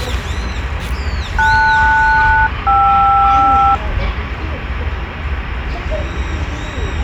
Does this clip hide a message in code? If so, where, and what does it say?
Yes: aircraft SELCAL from 1.4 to 3.7 s, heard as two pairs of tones, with radio hiss and the noise of a park. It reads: LS-KR